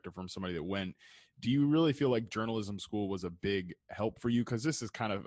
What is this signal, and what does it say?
Speech in English. There is no code.